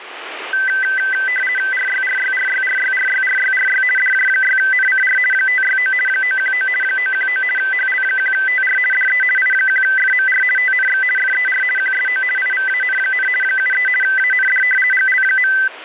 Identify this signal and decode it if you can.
RTTY (50 baud, 450 Hz shift), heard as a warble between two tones, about 1750 Hz centre, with radio static. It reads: RYRYRYRYRYRYRY DJ6NCR 569 919 919 HL1TR DE I1FMR TNX FER QSO IVAN, 73 AND GL.